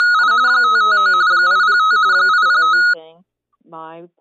RTTY (45.45 baud, 170 Hz shift), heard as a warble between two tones, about 1360 Hz centre. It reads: … 559 805 805